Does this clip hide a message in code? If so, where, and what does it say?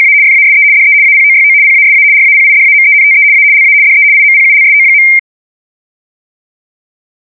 Yes: RTTY (75 baud, 170 Hz shift) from 0.0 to 5.2 s, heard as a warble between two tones, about 2200 Hz centre. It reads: … FASE DE APOYO PASA RAPIDAMENTE A LA DE IMPULSO.